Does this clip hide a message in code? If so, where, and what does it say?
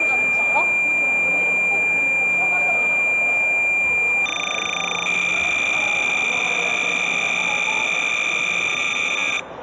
Yes: cassette data (Kansas City type), 300 baud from 0.0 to 9.4 s, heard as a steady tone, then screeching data, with the noise of a crowd indoors.